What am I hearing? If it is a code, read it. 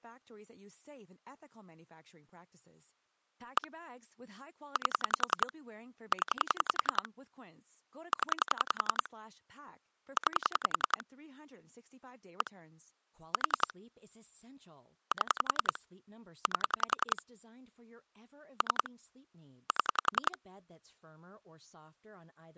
Pulse dialling, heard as clicks on a phone line, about 10 pulses a second, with speech in English. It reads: 1 8 0 0 9 1 4 7 8 3 7